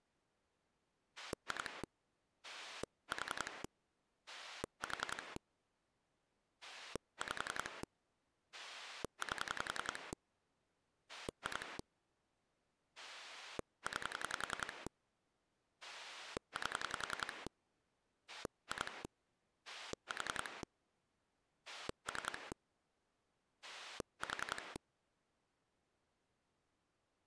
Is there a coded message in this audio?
Yes: pulse dialling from 1.2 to 24.8 s, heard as a rotary dial, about 10 pulses a second. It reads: 2 4 4 5 8 2 9 8 2 4 3 4